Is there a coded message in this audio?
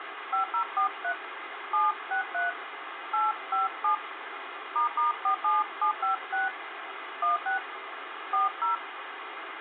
Yes: DTMF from 0.3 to 8.8 s, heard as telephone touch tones, dialled by hand, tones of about 130 ms, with phone line noise. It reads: 5043 763 857 **47756 16 40